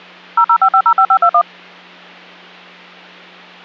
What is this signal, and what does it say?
DTMF, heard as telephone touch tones, dialled by machine, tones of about 70 ms, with hum. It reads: 005505521